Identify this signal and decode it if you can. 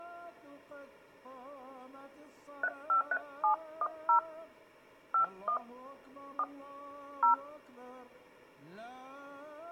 DTMF, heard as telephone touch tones, dialled by hand, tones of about 80 ms. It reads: 353710 51 4 0